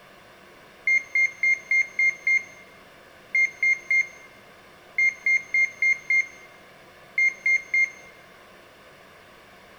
Beep code, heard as a piezo beeper, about 2100 Hz, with room echo. 6-3-5-3.